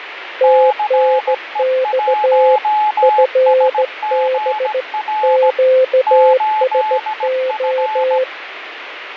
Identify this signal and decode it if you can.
Morse code, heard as two keyed tones, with radio static. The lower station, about 16 wpm, 520 Hz: TNX FB QSO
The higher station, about 17 wpm, 850 Hz: CE1SGR 8F